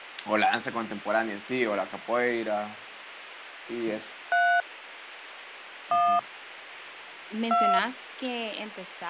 DTMF, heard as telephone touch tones, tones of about 280 ms, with speech in Spanish. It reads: 3 1 2